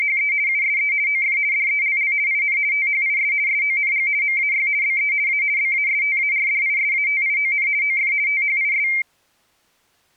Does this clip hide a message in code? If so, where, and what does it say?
Yes: RTTY (50 baud, 170 Hz shift) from 0.0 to 9.0 s, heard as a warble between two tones, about 2200 Hz centre. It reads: … USE OF DELL IN THIS SONG MAY BE A BASTARDISATION OF THIS